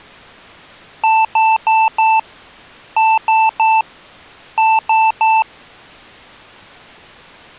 Beep code, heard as beeps from a small speaker, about 880 Hz. 4-3-3. In Phoenix BIOS tables: timer channel 2 failure.